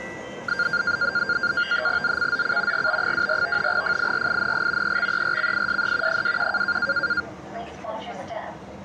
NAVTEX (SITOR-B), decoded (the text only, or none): ZCZC GB24 FIRING EXERCISE 21